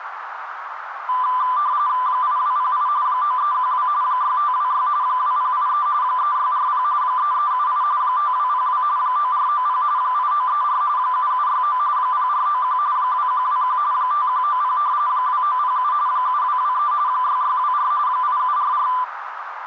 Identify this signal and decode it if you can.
RTTY (45.45 baud, 170 Hz shift), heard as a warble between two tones, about 1090 Hz centre, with radio static and a narrow filter. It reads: 8208 9312 6526 2083 3640 3378 5202 9490 8934 7769 0491 2121 5190 2907 7223 6624 8744